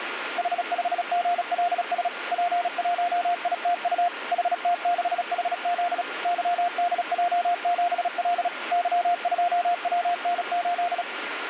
Morse code, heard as a keyed tone, machine-sent, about 36 wpm, 700 Hz, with radio static. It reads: H5GLS P1ITU HT6HZ YDJ7L Y2WN8